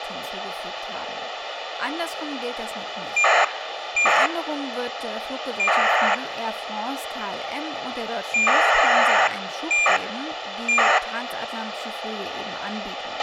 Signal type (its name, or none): ACARS aircraft data